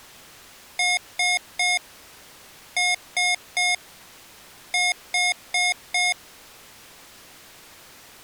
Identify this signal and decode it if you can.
Beep code, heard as beeps from a small speaker, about 720 Hz. 3-3-4. In Phoenix BIOS tables: video failure.